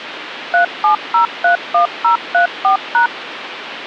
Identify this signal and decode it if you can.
DTMF, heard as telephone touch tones, dialled by machine, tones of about 110 ms, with phone line noise. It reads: 37031034#